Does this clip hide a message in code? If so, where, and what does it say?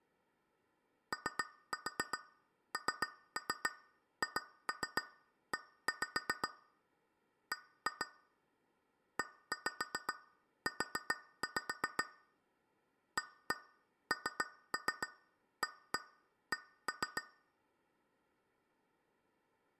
Yes: tap code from 1.1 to 17.3 s, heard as taps on glass, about 7 knocks a second, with room echo. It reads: ONHE B EU ANAC